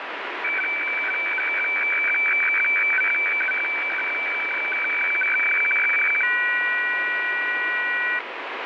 Weather fax (radiofax), 120 lines a minute, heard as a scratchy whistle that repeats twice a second, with radio static.